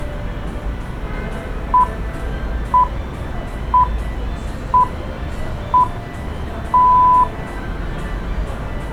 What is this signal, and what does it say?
Radio time signal (six pips, as the Greenwich Time Signal), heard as pips, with street noise.